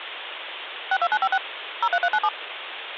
DTMF, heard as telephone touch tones, dialled by machine, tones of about 60 ms, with phone line noise. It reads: 62956 03397